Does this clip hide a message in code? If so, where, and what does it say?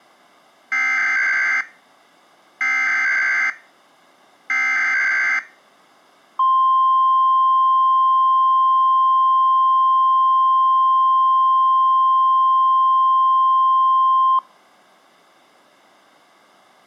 Yes: Emergency Alert System (SAME) tones (header bursts, then the 1050 Hz attention tone) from 0.7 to 14.4 s, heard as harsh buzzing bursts, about 520.83 baud.